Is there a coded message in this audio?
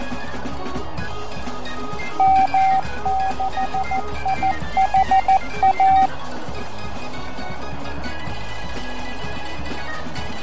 Yes: Morse code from 2.1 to 6.1 s, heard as a keyed tone, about 14 wpm, 770 Hz, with radio static, fading and a narrow filter. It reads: M6IHA